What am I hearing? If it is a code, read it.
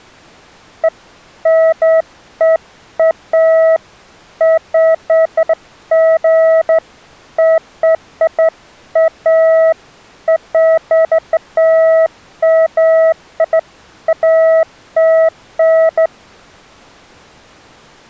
Beeps of irregular length. There is no code.